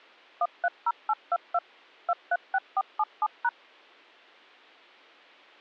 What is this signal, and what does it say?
DTMF, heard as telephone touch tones, dialled by machine, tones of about 50 ms. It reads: 130822 236477#